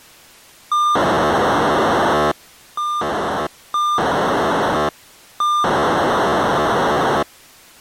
POCSAG pager data (2400 baud), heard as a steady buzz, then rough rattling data.